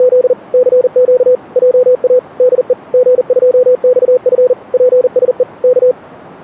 Morse code, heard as a keyed tone, machine-sent, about 40 wpm, 500 Hz. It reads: … CQ JA DE G2XF PSE K